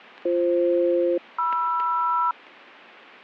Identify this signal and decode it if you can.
Aircraft SELCAL, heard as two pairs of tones. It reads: BF-MR